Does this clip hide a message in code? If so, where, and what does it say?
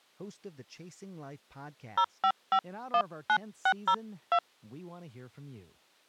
Yes: DTMF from 2.0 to 4.4 s, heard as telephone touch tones, dialled by hand, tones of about 70 ms, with speech in English. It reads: 05519602